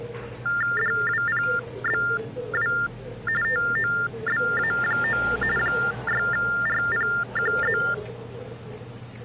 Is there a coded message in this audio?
Yes: TTY/TDD text telephone tones (45.45 baud Baudot) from 0.5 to 7.9 s, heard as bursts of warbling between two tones, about 400 Hz shift, 1600 Hz centre, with the noise of a restaurant. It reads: DWPBW TOBA9 6RPQZ